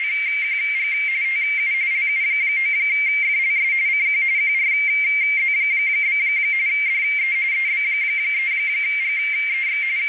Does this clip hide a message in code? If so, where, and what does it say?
Yes: RTTY (45.45 baud, 170 Hz shift) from 0.0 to 10.1 s, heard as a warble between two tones, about 2200 Hz centre, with radio static and a narrow filter. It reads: … TU LU9FLS CQ QRZ? DE EB3GEX …